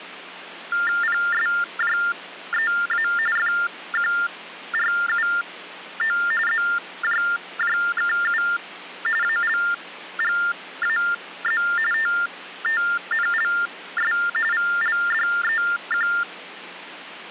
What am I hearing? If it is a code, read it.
TTY/TDD text telephone tones (45.45 baud Baudot), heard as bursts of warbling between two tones, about 400 Hz shift, 1600 Hz centre, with phone line noise. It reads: PSJEA FQRUO ZJJKU ALGAZ TTNLS VLDEQ